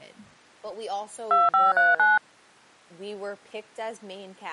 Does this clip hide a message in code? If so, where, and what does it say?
Yes: DTMF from 1.3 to 2.2 s, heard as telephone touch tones, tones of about 180 ms, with speech in English. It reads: 2539